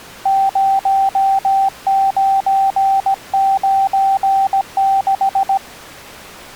Morse code, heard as a keyed tone, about 17 wpm, 780 Hz. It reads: 0996